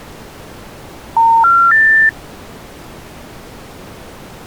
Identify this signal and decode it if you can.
Telephone call progress tone (North American plan), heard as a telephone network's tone, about 910, 1370, 1800 Hz. Special information tone.